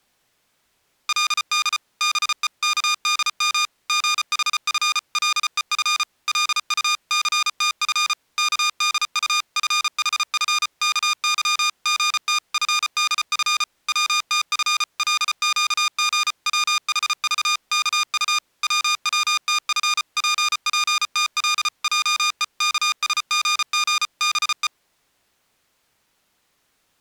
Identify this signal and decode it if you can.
Morse code (Korean alphabet), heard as electronic beeps, machine-sent, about 34 wpm, 1220 Hz. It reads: 그 다음 순간 기천 의눈에서는 번갯불이 뻔쩍하였다